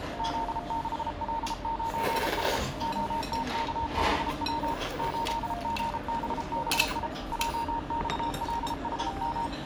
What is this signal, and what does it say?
Morse code, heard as a keyed tone, machine-sent, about 33 wpm, 920 Hz, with the noise of a restaurant. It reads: Z6L9S OTKBW 8GBBI JXLHM